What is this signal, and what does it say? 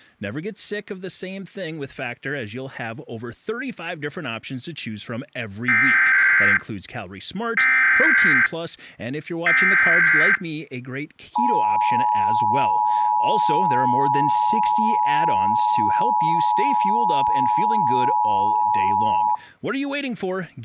Emergency Alert System (SAME) tones (header bursts, then the 853 and 960 Hz attention tone), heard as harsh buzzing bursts, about 520.83 baud, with speech in English.